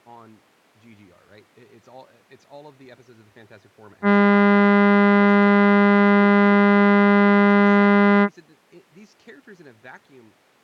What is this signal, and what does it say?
Ship horn signal, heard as a ship's horn, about 200 Hz, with speech in English. 1 long. At sea: a vessel nearing a blind bend, or under power and making way in fog.